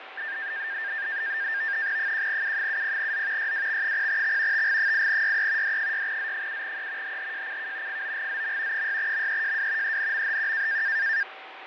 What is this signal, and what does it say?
NAVTEX (SITOR-B), 100 baud, 170 Hz shift, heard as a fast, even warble, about 1700 Hz centre, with radio static, fading and a steady whistle near 770 Hz. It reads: 1U70Z YWX0X TG8YE D6Z7E HHJCK FOGZM 6MEJW ENMHQ